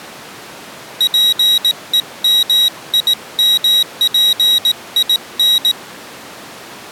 Morse code, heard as a high beeper, hand-sent with a paddle, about 18 wpm, 3850 Hz. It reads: PEMIMPIN